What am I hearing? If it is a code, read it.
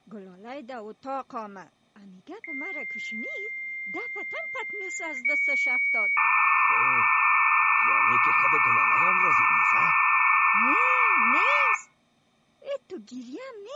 Dial-up modem handshake (low-speed, two carriers), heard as two whistles, then hiss.